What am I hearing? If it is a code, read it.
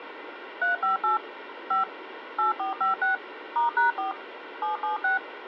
DTMF, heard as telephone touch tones, dialled by machine, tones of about 140 ms, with phone line noise. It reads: 358 5 8456 *#4 776